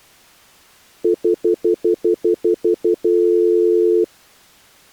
Telephone call progress tone (North American plan), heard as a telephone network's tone, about 350, 440 Hz, 0.1 s on and 0.1 s off. Stutter dial tone.